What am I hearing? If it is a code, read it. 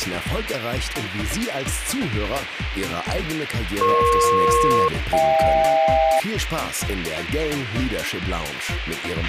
Aircraft SELCAL, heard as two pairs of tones, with radio hiss and a squelch burst at the end. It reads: EP-HK